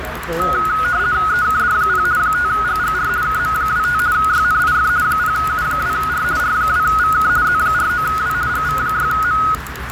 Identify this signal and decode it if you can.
RTTY (50 baud, 170 Hz shift), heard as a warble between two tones, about 1360 Hz centre, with radio static, a narrow filter and the noise of a crowd indoors. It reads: EKD0 5GGR KM25 YNIF 0U2R R2VK Z49W GV6M